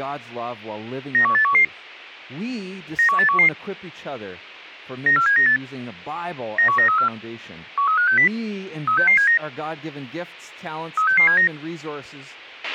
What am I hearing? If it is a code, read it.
Five-tone selective call (CCIR), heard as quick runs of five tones, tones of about 100 ms, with a squelch burst at the end. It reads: 91811 91811 94798 91934 13560 36679 36679